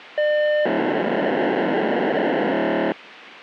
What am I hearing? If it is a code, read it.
POCSAG pager data (1200 baud), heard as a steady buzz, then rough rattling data, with radio hiss.